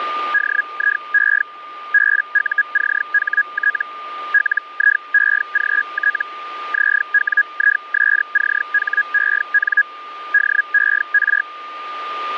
Hellschreiber (Feld-Hell, 122.5 baud), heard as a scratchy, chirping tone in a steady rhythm, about 1650 Hz, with a steady whistle near 1210 Hz. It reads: DIE BUCHT LIEGT ZWISCHEN DER